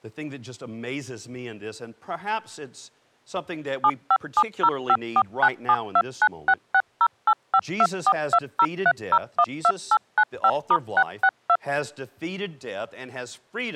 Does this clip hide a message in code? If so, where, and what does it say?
Yes: DTMF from 3.8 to 11.6 s, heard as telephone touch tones, dialled by machine, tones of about 60 ms, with speech in English. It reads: 75705497296608524203012895*662